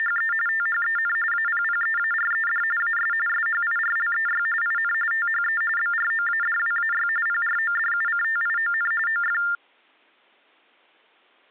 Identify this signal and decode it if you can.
TTY/TDD text telephone tones (45.45 baud Baudot), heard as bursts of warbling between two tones, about 400 Hz shift, 1600 Hz centre. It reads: … THEN APPEARED AS SHIRLEY IN THE BROADWAY PRODUCTION OF